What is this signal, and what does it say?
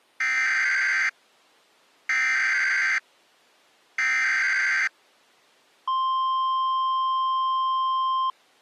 Emergency Alert System (SAME) tones (header bursts, then the 1050 Hz attention tone), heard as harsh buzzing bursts, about 520.83 baud.